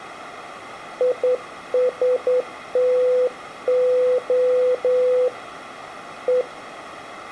Morse code, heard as a keyed tone, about 10 wpm, 500 Hz, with room echo. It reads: ISTO E